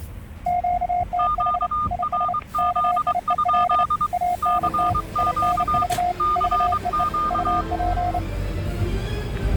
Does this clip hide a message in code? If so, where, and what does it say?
Yes: Morse code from 0.4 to 8.2 s, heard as two keyed tones, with static crashes and the noise inside a car. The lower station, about 30 wpm, 710 Hz: QTH IS KIEL ANT INV VEE UP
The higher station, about 23 wpm, 1210 Hz: QRZ? CQ CQ